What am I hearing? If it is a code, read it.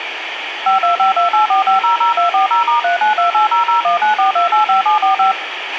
DTMF, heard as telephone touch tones, dialled by machine, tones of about 120 ms, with radio hiss and a squelch burst at the end. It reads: 525284500240*392800194285745